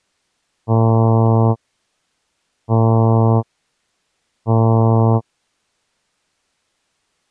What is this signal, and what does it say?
Ship horn signal, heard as a ship's horn, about 110 Hz. 3 short. At sea: I am operating astern propulsion.